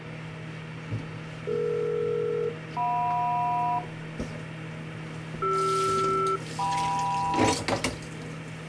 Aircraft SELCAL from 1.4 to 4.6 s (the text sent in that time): DE-JM